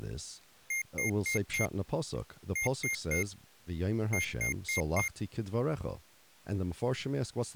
Beep code, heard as beeps from a small speaker, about 2100 Hz, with speech in English. 4-3-4. In Phoenix BIOS tables: time-of-day clock failure.